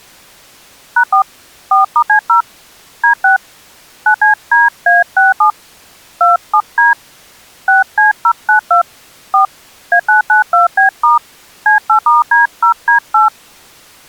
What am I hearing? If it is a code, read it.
DTMF, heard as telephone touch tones, dialled by hand, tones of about 120 ms. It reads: #4 4*C0 D6 9CDA67 27D 6C092 4 A992B* C8*D0D8